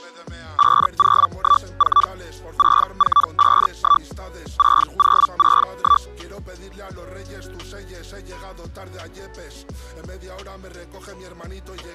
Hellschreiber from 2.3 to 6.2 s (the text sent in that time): 6451 6061